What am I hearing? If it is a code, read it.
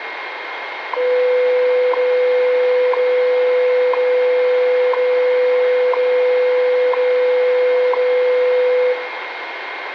Radio time signal (WWV, Colorado), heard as ticks, one a second, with radio static, a steady whistle near 2130 Hz and room echo.